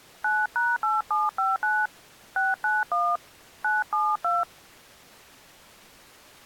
DTMF, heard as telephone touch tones, dialled by hand, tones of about 200 ms. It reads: 9#8759 691 972